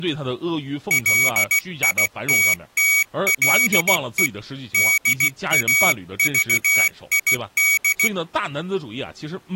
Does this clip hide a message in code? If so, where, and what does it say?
Yes: Morse code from 0.8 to 8.1 s, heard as a high beeper, hand-sent with a bug key, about 16 wpm, 2250 Hz, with speech in Chinese. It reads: LITTLE DAVID